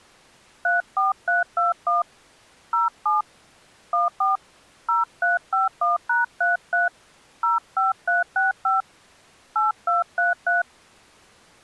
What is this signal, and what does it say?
DTMF, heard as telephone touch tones, dialled by hand, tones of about 160 ms. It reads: 34321 07 14 0351#33 05365 8233